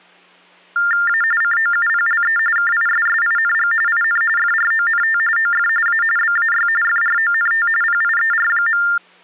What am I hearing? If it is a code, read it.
TTY/TDD text telephone tones (45.45 baud Baudot), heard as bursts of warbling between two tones, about 400 Hz shift, 1600 Hz centre, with hum. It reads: A COUPLE KISSING IN FRONT OF A BAY FRONT PIER.